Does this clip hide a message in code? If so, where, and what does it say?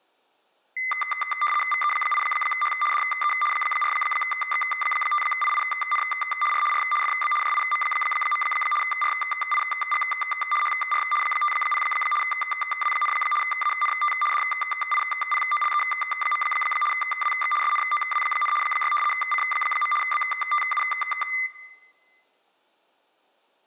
Yes: RTTY (75 baud, 850 Hz shift) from 0.8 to 21.5 s, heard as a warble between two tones, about 1600 Hz centre, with room echo. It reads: VE8H DE 4X5IIN R R FB JIM. RIG HR 50 W, ANT DIPOLE. WX SNOW, 6 C. BTU